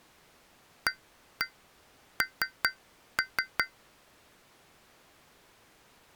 Tap code, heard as taps on glass, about 5 knocks a second. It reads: AN